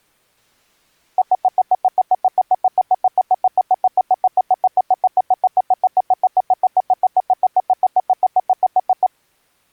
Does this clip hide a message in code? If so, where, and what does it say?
No, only evenly repeated beeps.